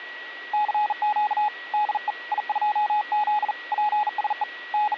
Morse code, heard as a keyed tone, hand-sent with a bug key, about 40 wpm, 840 Hz, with a steady whistle near 1920 Hz. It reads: CQ DE I2Z PSE …